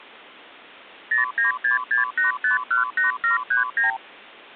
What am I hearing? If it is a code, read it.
Multi-frequency trunk signalling (R2, with the far end's replies), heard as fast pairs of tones, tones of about 130 ms. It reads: 09668518739